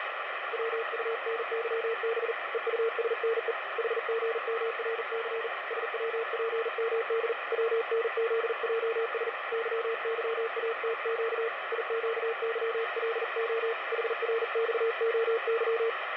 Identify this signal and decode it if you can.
Morse code, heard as a keyed tone, hand-sent with a paddle, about 40 wpm, 460 Hz, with radio static. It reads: WUNYB EUSNE HGMRC SWPMD WNZJS YYATQ IQYLO HRXOY